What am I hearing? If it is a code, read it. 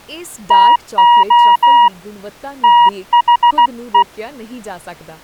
Morse code, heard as a keyed tone, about 16 wpm, 960 Hz, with speech in Punjabi. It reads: TO THE